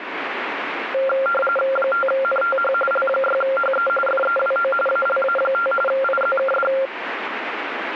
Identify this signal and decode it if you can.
RTTY (45.45 baud, 850 Hz shift), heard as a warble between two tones, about 960 Hz centre, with radio static. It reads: 5NTH L6HE FEWO ALA5 IZKD